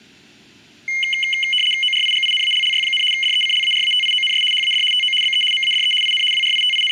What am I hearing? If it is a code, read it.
RTTY (75 baud, 850 Hz shift), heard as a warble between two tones, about 2550 Hz centre. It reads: ORIGINALLY, DECLARATIONS HAD TO BE MADE IN …